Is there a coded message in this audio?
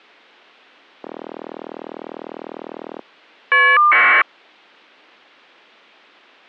Yes: caller ID data burst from 1.0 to 4.2 s, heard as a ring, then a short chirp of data, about 1200 baud.